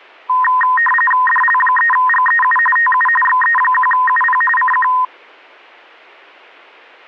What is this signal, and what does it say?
RTTY (45.45 baud, 850 Hz shift), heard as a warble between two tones, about 1440 Hz centre. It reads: DL3GEU TU XE1UP CQ